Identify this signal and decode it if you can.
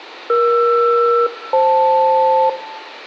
Aircraft SELCAL, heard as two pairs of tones, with radio hiss and room echo. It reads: ER-FL